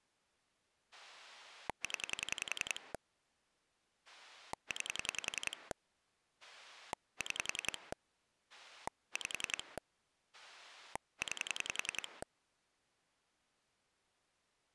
Pulse dialling, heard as a rotary dial, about 10 pulses a second. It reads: 0 9 6 5 9